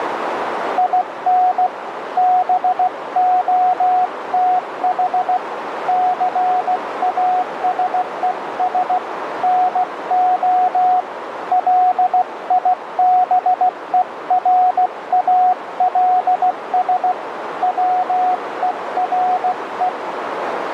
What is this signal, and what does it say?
Morse code, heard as a keyed tone, hand-sent with a paddle, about 16 wpm, 730 Hz, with radio static and a narrow filter. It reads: IN BOTH CASES NO LIBERALS WERE